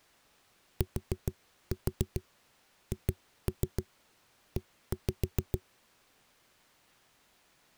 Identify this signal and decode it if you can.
Tap code, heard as knocks on a wall, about 6 knocks a second. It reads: THE